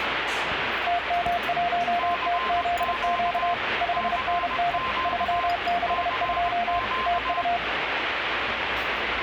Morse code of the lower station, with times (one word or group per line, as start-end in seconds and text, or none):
0.9-3.5 TM1TZQ
3.8-4.8 5NN
5.1-6.8 362
7.1-7.6 TU